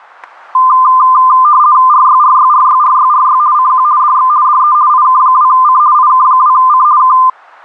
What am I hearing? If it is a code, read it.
RTTY (50 baud, 170 Hz shift), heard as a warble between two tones, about 1120 Hz centre, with static crashes. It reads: RYRYRYRYRY CQ DX DE IK2C IK2C K